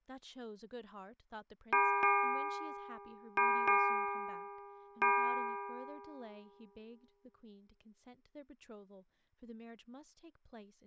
Ship's bell, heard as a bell, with room echo and speech in English. 5. Five half-hours of the watch have passed.